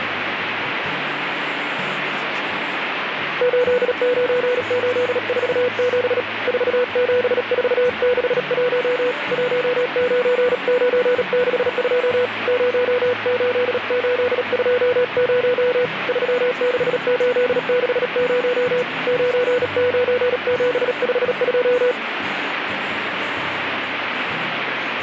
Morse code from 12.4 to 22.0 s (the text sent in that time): 08820 36860 99752